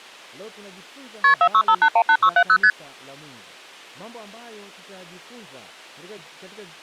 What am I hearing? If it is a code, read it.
Multi-frequency trunk signalling (R1, as on North American trunks), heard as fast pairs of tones, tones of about 70 ms, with speech in Swahili. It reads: KP 465818670 ST